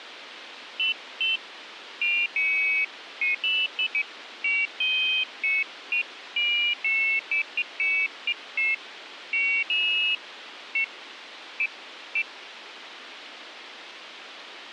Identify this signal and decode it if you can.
Pairs of high tones at irregular times, with radio hiss. There is no code.